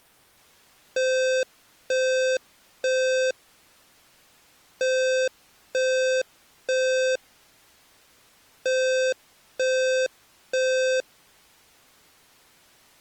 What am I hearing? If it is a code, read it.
Alarm pattern, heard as an alarm's beeps, played three times, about 520 Hz. Temporal three. Smoke or fire, evacuate.